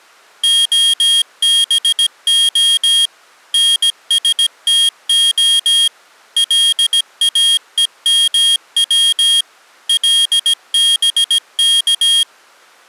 Morse code (Hebrew alphabet), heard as a high beeper, machine-sent, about 17 wpm, 3250 Hz. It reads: הבה נשתה לאומץ לבך